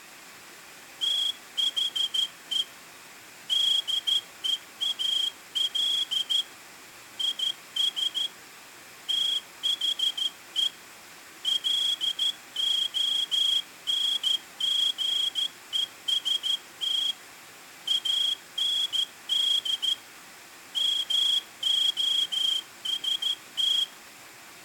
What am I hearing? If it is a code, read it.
Morse code, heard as a whistle, hand-sent with a straight key, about 13 wpm. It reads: THE DEAL IS THE LONGEST AND MOST